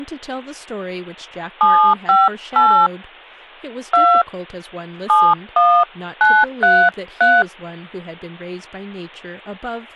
DTMF, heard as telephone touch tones, dialled by hand, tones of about 260 ms, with speech in English. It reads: 758 2 71933